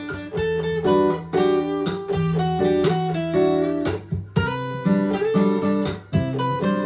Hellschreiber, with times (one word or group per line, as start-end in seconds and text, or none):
none